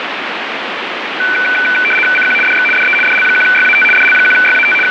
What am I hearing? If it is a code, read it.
RTTY (75 baud, 850 Hz shift), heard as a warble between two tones, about 1900 Hz centre, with radio static. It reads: CQ DX DE DL1YAT DL1YAT …